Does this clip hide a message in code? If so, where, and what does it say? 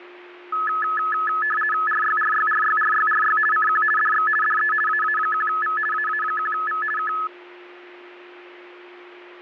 Yes: RTTY (50 baud, 450 Hz shift) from 0.5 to 7.3 s, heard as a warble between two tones, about 1500 Hz centre, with a steady whistle near 360 Hz. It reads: RYRYRYRYRY CQ DX DE AA1V AA1V K